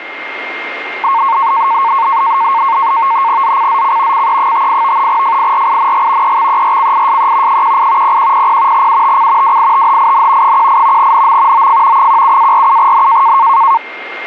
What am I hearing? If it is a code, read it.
NAVTEX (SITOR-B), 100 baud, 170 Hz shift, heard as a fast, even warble, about 1000 Hz centre, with radio static and a steady whistle near 2120 Hz. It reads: ZCZC CE58 FIRING EXERCISE 18 0100 UTC WITHIN 18 NM OF 17-47N